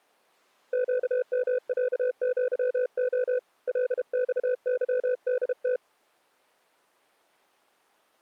Morse code (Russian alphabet), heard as a keyed tone, hand-sent with a paddle, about 32 wpm, 500 Hz. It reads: ЩМЯЪО ЛЬЫДТ